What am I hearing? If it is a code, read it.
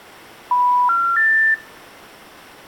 Telephone call progress tone (North American plan), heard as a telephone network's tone, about 980, 1370, 1800 Hz, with room echo. Special information tone.